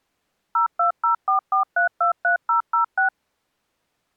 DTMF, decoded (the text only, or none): 02044323006